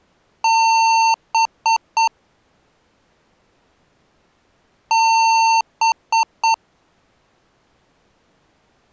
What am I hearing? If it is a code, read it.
Beep code, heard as beeps from a small speaker, played twice, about 900 Hz. 1 long, 3 short. In Award and IBM BIOS tables: video adapter failure; in AMI BIOS tables: memory failure.